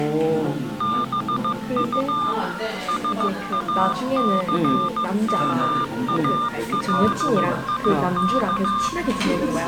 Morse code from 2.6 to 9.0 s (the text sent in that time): SACMALIK